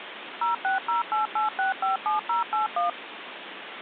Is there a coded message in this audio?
Yes: DTMF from 0.4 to 2.9 s, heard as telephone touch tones, dialled by machine, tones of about 140 ms, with phone line noise. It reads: 06088657081